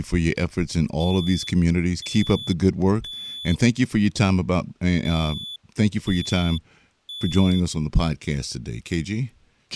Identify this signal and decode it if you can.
Alarm pattern, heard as an alarm's beeps, played twice, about 3450 Hz, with speech in English. Temporal three. Smoke or fire, evacuate.